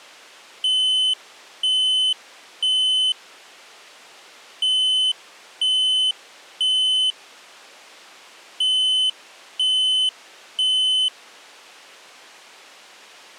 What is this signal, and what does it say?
Alarm pattern, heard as an alarm's beeps, played three times, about 3050 Hz. Temporal three. Smoke or fire, evacuate.